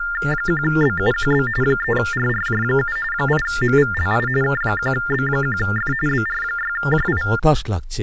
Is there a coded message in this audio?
Yes: TTY/TDD text telephone tones (45.45 baud Baudot) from 0.0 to 7.4 s, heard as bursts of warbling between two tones, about 400 Hz shift, 1600 Hz centre, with speech in Bangla. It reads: 1BUQB 3RRJ7 8MVLI K1B1F BR6JI